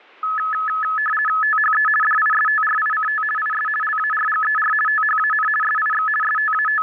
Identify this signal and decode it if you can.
RTTY (50 baud, 450 Hz shift), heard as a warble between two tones, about 1500 Hz centre. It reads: THE DISTRICT IS LARGER THAN SIX …